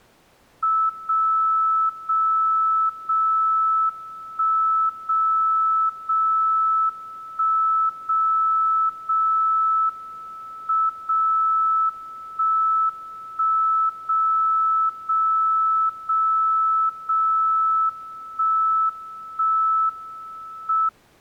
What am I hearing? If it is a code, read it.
Radio time signal (WWVB), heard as a tone whose level steps once a second, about 1310 Hz. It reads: 0 0 0 1 0 0 1 0 0 M 0 1 1 0 0 0 0 1 1 M